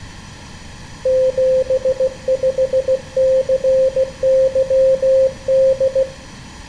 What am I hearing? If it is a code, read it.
Morse code, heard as a keyed tone, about 16 wpm, 520 Hz, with room echo. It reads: 75CYD